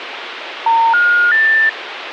Telephone call progress tone (North American plan), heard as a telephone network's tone, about 910, 1430, 1800 Hz, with phone line noise. Special information tone.